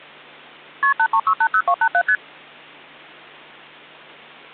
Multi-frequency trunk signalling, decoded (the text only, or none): KP 83680287 ST